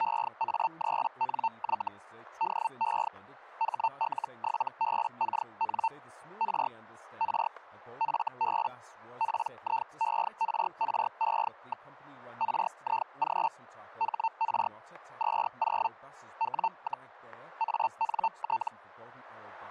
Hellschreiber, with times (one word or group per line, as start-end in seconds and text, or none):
0.0-1.9 EA3NY
2.4-3.1 DE
3.6-5.9 HL7BKN
6.4-6.7 R
7.2-7.5 R
8.0-8.7 FB
9.2-11.9 PIERRE.
12.4-13.5 RIG
14.0-14.7 HR
15.2-15.9 20
16.4-17.1 W,
17.6-18.7 ANT